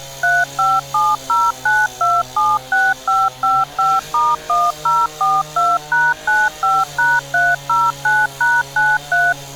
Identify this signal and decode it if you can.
DTMF, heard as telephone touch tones, dialled by machine, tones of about 210 ms, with street noise. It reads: 35709276555*1042#95#309#93